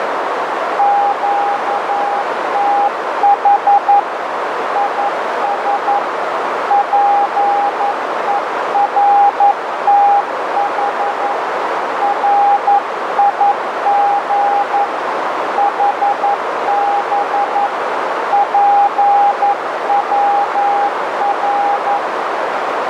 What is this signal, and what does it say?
Morse code, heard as a keyed tone, hand-sent with a paddle, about 11 wpm, 810 Hz, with heavy radio static and a narrow filter. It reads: QTH IS PERTH RIG HB PWR